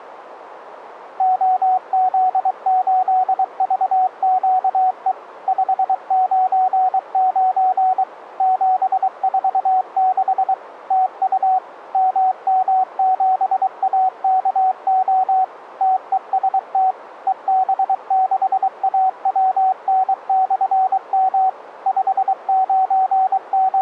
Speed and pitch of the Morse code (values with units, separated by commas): 23 wpm, 750 Hz